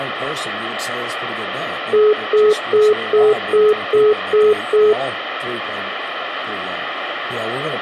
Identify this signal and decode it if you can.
Telephone call progress tone (single-tone plan, as in most of Europe), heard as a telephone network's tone, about 420 Hz, 0.2 s on and 0.2 s off, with phone line noise. Congestion tone.